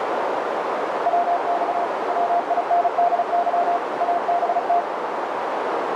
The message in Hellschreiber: none

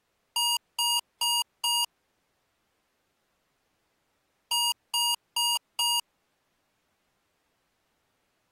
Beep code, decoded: 4 short

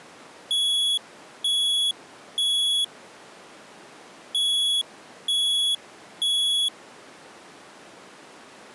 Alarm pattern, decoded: temporal three

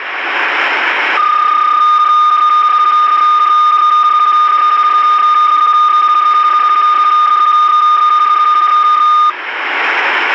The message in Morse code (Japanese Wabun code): none

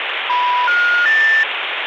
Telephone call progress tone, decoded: special information tone

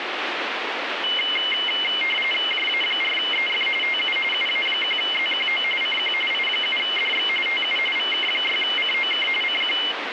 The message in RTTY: JA4EF TU UA1ZQO CQ I7DX TU VK6COK CQ

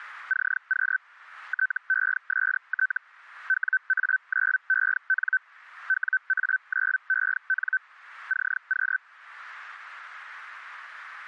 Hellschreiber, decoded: CQ TEST WA9EN WA9EN CQ

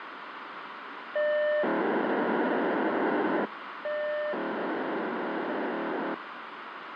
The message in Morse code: none

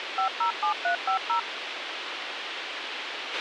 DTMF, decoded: 507350

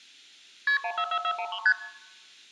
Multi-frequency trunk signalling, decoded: KP 144413 ST

